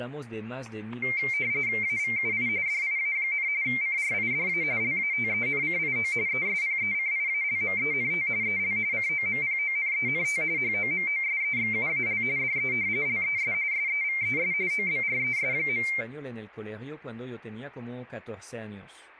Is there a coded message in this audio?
Yes: RTTY (45.45 baud, 170 Hz shift) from 1.0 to 16.0 s, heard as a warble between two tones, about 2200 Hz centre, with static crashes and speech in French. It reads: AVUI DIA, CRIDA LATENCIO ESPECIALMENT EL COMPONENT HOMOSEXUAL DE LES SEVES OBRES.